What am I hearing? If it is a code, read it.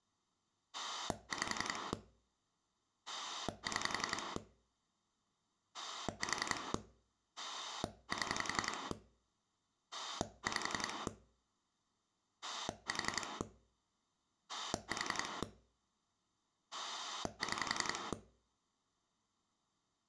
Pulse dialling, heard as a rotary dial, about 11 pulses a second. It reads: 5 6 4 7 5 4 4 6